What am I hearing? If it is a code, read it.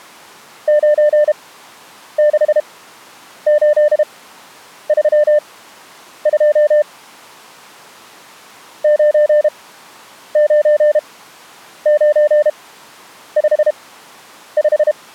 Morse code, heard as a keyed tone, machine-sent, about 32 wpm, spaced as for 9 wpm, 600 Hz. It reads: 96832 99955